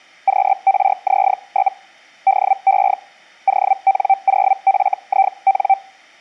Hellschreiber (Feld-Hell, 122.5 baud), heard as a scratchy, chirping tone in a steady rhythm, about 780 Hz. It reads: QRZ? DE ON0FIN